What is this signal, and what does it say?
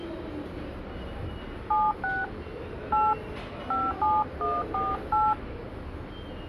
DTMF, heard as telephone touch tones, dialled by hand, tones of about 210 ms, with the noise of a subway station. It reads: 76 8 57148